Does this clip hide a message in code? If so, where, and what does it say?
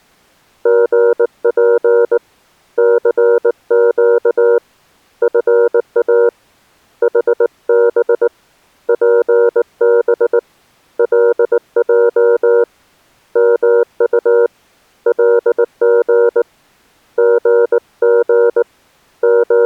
Yes: Morse code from 0.6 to 19.7 s, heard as a keyed tone, hand-sent with a paddle, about 19 wpm, 470 Hz. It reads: GP CQ FA HB PB LJ MU LG GG …